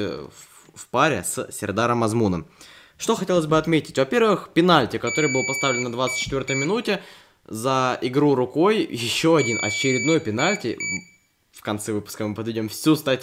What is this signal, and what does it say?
Beep code, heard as a piezo beeper, played twice, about 2300 Hz, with room echo and speech in Russian. 1 long, 2 short. In Award, IBM and AMI BIOS tables: video adapter failure.